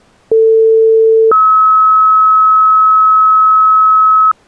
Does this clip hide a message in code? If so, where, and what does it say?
Yes: two-tone page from 0.3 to 4.3 s, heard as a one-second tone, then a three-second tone, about 450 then 1290 Hz.